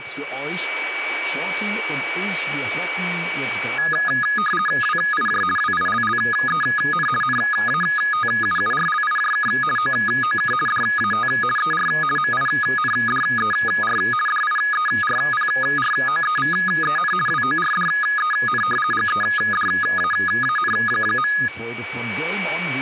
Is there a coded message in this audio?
Yes: RTTY (50 baud, 450 Hz shift) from 3.8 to 21.5 s, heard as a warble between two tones, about 1460 Hz centre, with a steady whistle near 2280 Hz and speech in German. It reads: WIJ WILLEN NATUURLIJK OOK DAT ER MINDER DIERPROEVEN WORDEN GEDAAN.